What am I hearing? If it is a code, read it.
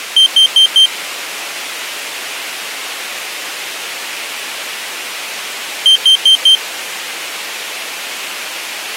Alarm pattern, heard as an alarm's beeps, played twice, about 3150 Hz. Temporal four. Carbon monoxide.